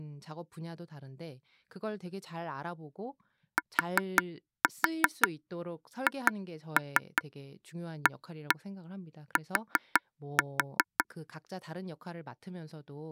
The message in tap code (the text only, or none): THAT